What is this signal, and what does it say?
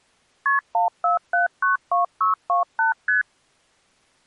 Multi-frequency trunk signalling (R1, as on North American trunks), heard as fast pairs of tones, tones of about 130 ms. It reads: KP 14792628 ST